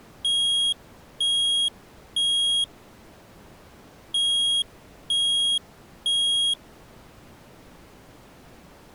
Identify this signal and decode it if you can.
Alarm pattern, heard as an alarm's beeps, played twice, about 3300 Hz. Temporal three. Smoke or fire, evacuate.